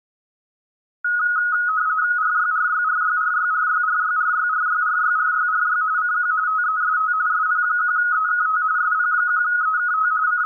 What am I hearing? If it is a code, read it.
RTTY (45.45 baud, 170 Hz shift), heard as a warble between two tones, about 1360 Hz centre. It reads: RYRYRYRYRYRYRYRYRYRYRY CQ TEST SP1EKT SP1EKT …